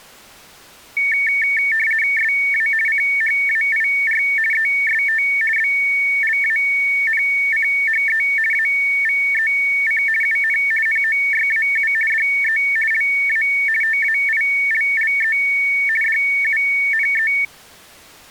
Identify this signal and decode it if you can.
RTTY (50 baud, 450 Hz shift), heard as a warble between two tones, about 2000 Hz centre. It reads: SA CHAIR EST BLANCHE AVEC UN NOYAU DE LA TAILLE DUNE